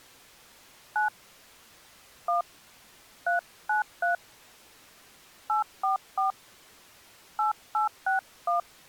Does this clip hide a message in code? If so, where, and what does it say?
Yes: DTMF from 1.0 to 8.6 s, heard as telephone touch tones, dialled by hand, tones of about 130 ms. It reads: 9 1 393 844 8861